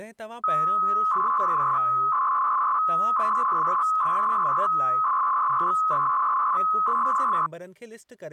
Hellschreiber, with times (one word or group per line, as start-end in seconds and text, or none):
none